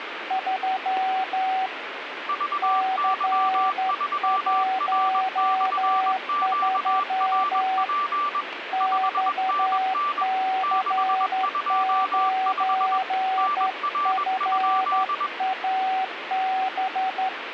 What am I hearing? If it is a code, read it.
Morse code, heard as two keyed tones, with radio static. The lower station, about 12 wpm, 760 Hz: 3 C13 XC9FAB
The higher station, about 21 wpm, 1170 Hz: VY3R/QRP 5NN 625 NR?